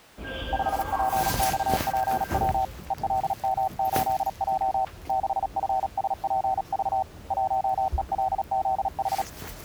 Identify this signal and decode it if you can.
Morse code, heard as a keyed tone, hand-sent with a paddle, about 37 wpm, 760 Hz, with the noise inside a subway train. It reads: 5PXPW ELM8J 6FSPV 1ELZH